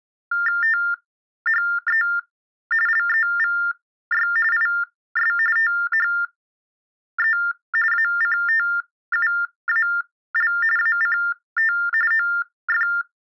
TTY/TDD text telephone tones (45.45 baud Baudot), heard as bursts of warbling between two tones, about 400 Hz shift, 1600 Hz centre. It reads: THE LEVY IS THE ACTUAL ACT OF